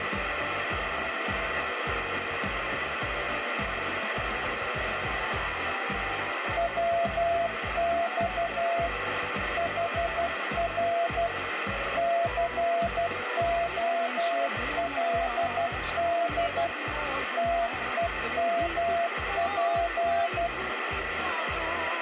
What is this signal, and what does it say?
Morse code, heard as a keyed tone, machine-sent, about 12 wpm, 680 Hz, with radio static. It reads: WX HR COLD TEMP